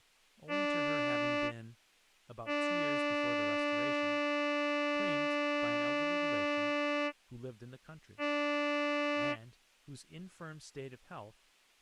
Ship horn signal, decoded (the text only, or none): 1 short, 1 long, 1 short